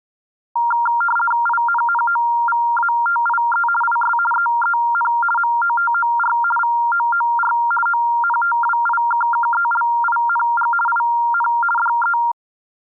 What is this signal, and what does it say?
RTTY (50 baud, 450 Hz shift), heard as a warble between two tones, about 1170 Hz centre. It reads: INNOVATIE IS EEN MOTOR VOOR ONTWIKKELING IN DE